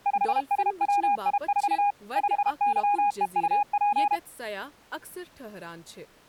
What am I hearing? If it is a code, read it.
Morse code, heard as a keyed tone, machine-sent, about 32 wpm, 820 Hz, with speech in Kashmiri. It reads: 5SWI4 5YEUP